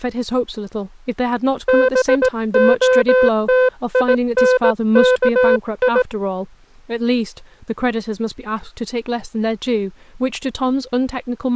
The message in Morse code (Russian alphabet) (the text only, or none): БОТИНКИ